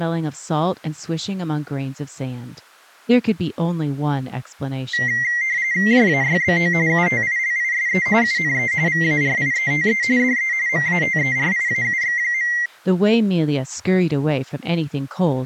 RTTY (45.45 baud, 170 Hz shift), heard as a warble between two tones, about 2000 Hz centre, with speech in English. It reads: JAYBO UTILISE UNE VARIETE DE MATERIAUX.